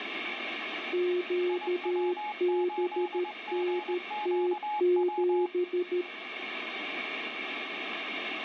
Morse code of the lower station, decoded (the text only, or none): QBNT7